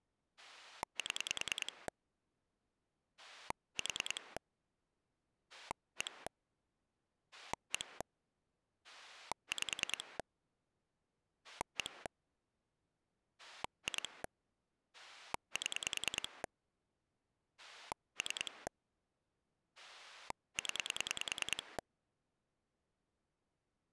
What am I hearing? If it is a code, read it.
Pulse dialling, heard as a rotary dial, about 10 pulses a second. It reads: 7 4 1 1 5 1 2 7 3 0